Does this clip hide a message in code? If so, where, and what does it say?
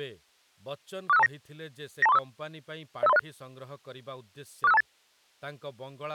Yes: five-tone selective call (EIA) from 1.1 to 4.8 s, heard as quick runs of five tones, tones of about 30 ms, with speech in Odia. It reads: 46529 92345 05306 46528